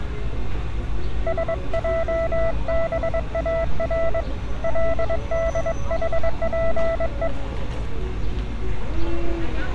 Morse code, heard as a keyed tone, hand-sent with a paddle, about 22 wpm, 660 Hz, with street noise. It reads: SJBAR LDHPE